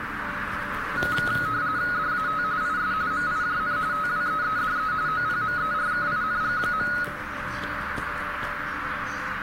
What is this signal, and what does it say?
RTTY (45.45 baud, 170 Hz shift), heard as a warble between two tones, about 1360 Hz centre, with radio static, a narrow filter and the noise inside a lift. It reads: DAT IS MIJN TWEEDE OPMERKING.